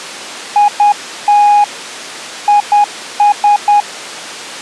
Morse code, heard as a keyed tone, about 10 wpm, 830 Hz. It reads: IT IS